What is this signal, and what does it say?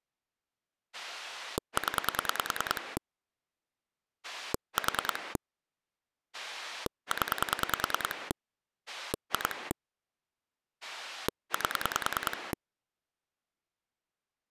Pulse dialling, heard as a rotary dial, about 10 pulses a second. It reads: 0 4 0 2 8